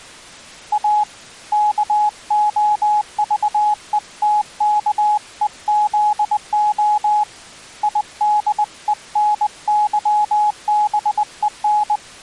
Morse code, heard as a keyed tone, hand-sent with a paddle, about 20 wpm, 840 Hz. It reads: A KOVETKEZO IDENYBEN